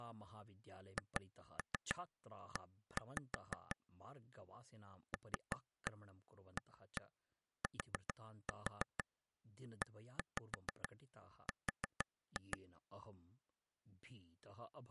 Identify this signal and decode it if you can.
Tap code, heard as taps on a table, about 6 knocks a second, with speech in Sanskrit. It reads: HE LATER